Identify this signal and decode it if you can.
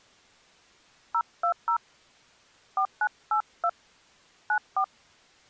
DTMF, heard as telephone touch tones, dialled by hand, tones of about 80 ms. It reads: 020 4982 94